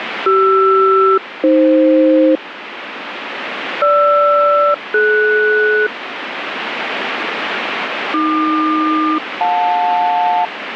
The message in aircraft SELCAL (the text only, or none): CR-AF GR-DS AQ-JL